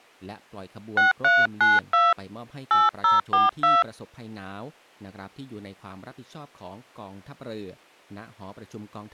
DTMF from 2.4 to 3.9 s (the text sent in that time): 8042